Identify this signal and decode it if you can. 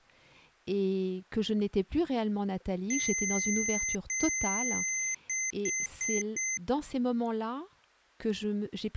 Beep code, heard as beeps from a small speaker, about 2050 Hz, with speech in French. 2 long, 4 short.